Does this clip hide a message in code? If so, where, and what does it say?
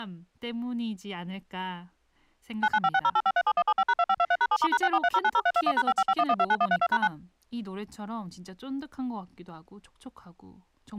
Yes: DTMF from 2.6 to 7.1 s, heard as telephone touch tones, dialled by machine, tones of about 50 ms, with speech in Korean. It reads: 995608537175#2523#7*#643090321#5551129132#9